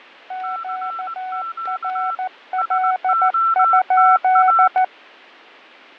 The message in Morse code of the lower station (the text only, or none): QRL?